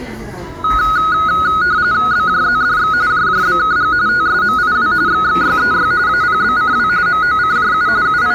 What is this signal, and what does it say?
RTTY (45.45 baud, 170 Hz shift), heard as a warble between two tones, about 1360 Hz centre, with the noise of a cafe. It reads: BJZDX JJBKG TSMIW XXYEY APBCW MOCJU …